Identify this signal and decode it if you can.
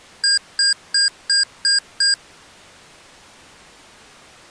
Beep code, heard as beeps from a small speaker, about 1600 Hz. 6 short. In AMI BIOS tables: keyboard controller gate A20 failure; in Dell tables: video card failure.